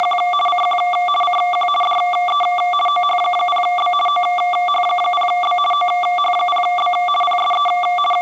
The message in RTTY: … CQ CQ DE OH0B OH0B OH0B PSE …

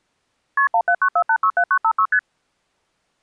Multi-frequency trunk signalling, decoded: KP 1794867956 ST

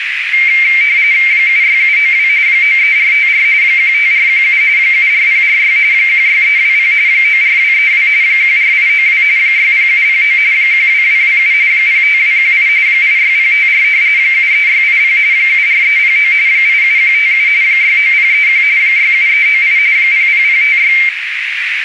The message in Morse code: none

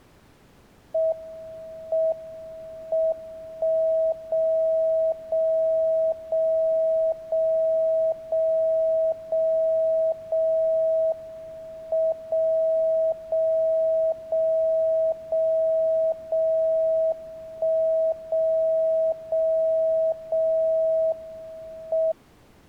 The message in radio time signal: M M 1 0 0 0 0 0 0 0 M 0 0 0 0 0 1 0 0 0 M

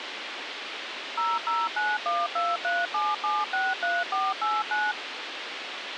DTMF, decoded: 0091237763489

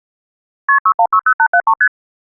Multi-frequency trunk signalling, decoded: KP 6160873 ST

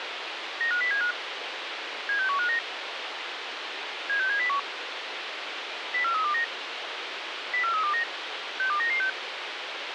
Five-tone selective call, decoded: 95075 76159 76701 04329 04329 62996

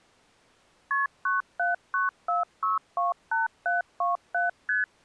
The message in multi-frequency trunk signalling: KP 9794628727 ST

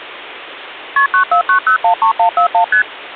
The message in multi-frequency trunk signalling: KP 949013141 ST

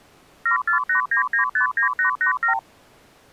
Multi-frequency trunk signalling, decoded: 7489959887

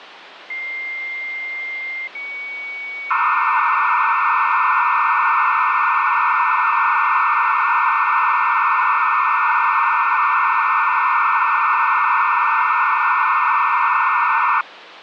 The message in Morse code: none

